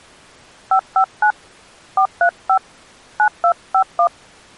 DTMF, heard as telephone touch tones, dialled by hand, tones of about 80 ms. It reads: 559 435 9251